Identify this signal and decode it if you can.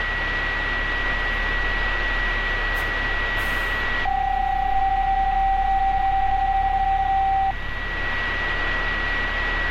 PSK31 (31.25 baud), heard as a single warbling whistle, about 780 Hz, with a steady whistle near 1930 Hz and street noise.